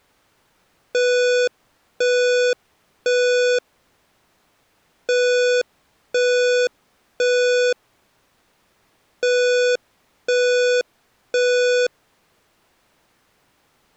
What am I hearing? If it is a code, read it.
Alarm pattern, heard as an alarm's beeps, played three times, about 490 Hz. Temporal three. Smoke or fire, evacuate.